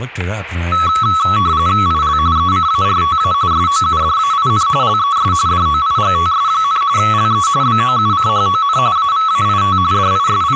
RTTY (45.45 baud, 170 Hz shift), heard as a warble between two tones, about 1210 Hz centre, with static crashes and speech in English. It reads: IL ECARTA SOUDAIN LES DOIGTS, LE BOUCHON AVAIT …